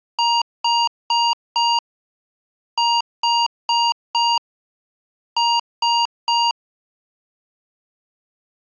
Beep code, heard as beeps from a small speaker, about 940 Hz. 4-4-3. In Phoenix BIOS tables: maths coprocessor failure.